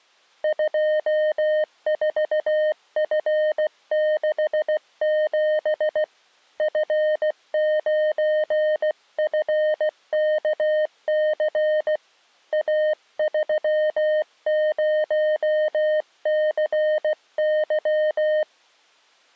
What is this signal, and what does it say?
Morse code, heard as a keyed tone, hand-sent with a paddle, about 16 wpm, 610 Hz. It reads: 24F67 F9FKC A30CY